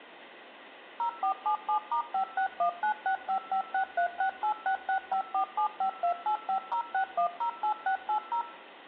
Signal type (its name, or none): DTMF